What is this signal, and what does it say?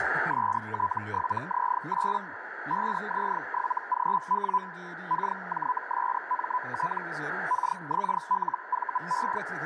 Hellschreiber (Feld-Hell, 122.5 baud), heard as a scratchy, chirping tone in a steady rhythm, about 1000 Hz, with radio static, a narrow filter and speech in Korean. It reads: ST7Z8 5Z7GW KJSMT KXLVE